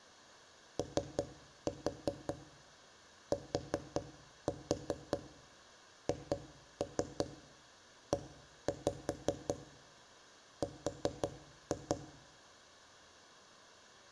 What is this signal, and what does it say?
Tap code, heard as knocks on wood, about 5 knocks a second, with room echo. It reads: OTHER